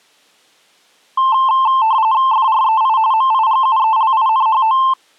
RTTY (45.45 baud, 170 Hz shift), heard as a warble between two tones, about 970 Hz centre. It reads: FREI MIGUELINHO